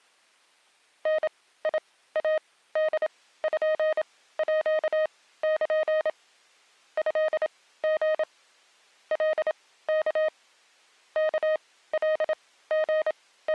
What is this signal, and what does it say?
Morse code (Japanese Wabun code), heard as a keyed tone, machine-sent, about 27 wpm, spaced as for 16 wpm, 620 Hz. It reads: ダイポール トリ カワ …